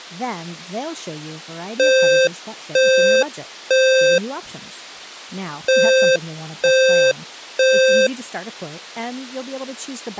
Alarm pattern, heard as an alarm's beeps, played twice, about 520 Hz, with speech in English. Temporal three. Smoke or fire, evacuate.